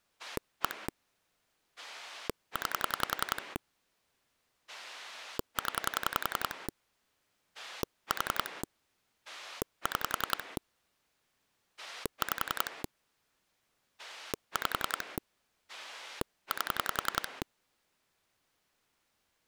Pulse dialling, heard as a rotary dial, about 10 pulses a second. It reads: 1 9 0 4 6 5 5 8